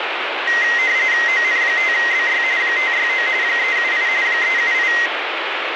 RTTY (45.45 baud, 170 Hz shift), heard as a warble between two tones, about 2000 Hz centre, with radio static. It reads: ON5BY 569 378 378